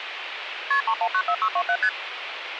Multi-frequency trunk signalling (R1, as on North American trunks), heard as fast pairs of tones, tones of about 70 ms, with phone line noise. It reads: KP 3194627 ST